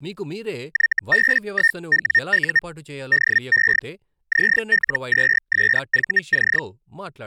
Hellschreiber (Feld-Hell, 122.5 baud), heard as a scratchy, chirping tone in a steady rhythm, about 1850 Hz, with speech in Telugu. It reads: YB1WU DE ZL2SVC